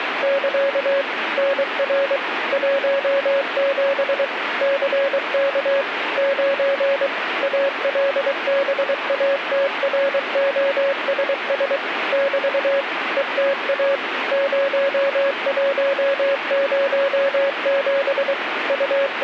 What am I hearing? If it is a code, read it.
Morse code, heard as a keyed tone, machine-sent, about 23 wpm, 550 Hz, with radio static. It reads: <KA> NR 17 CK 9 ALBATROSS <BT> ETA 0107 …